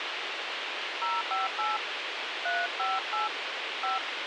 DTMF, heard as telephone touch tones, dialled by hand, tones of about 170 ms, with radio hiss. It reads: 058 358 5